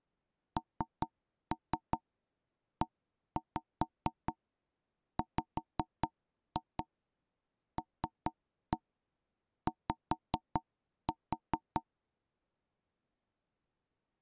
Tap code, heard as knocks on wood, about 4 knocks a second. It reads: NEWLY